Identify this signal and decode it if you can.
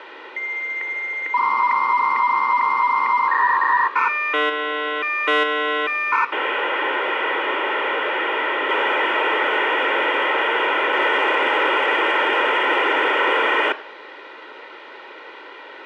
Dial-up modem handshake (V.34 or later), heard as a whistle, warbles, then hiss, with phone line noise and room echo.